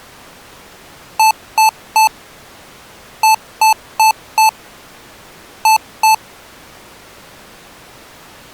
Beep code, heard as beeps from a small speaker, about 880 Hz. 3-4-2.